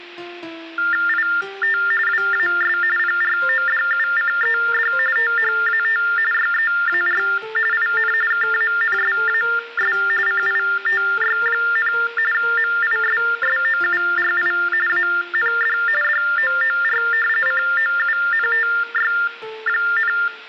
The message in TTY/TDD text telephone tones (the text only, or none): IT WAS PRODUCED THAT YEAR IN KANSAS CITY, MISSOURI AND DOOR COUNTY,